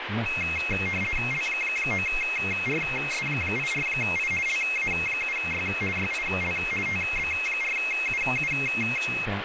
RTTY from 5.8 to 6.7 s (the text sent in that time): YIL